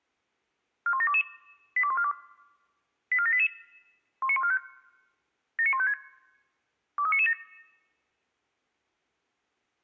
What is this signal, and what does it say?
Five-tone selective call (ZVEI), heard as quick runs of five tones, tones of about 70 ms. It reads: 41722 82142 84788 19145 79156 23997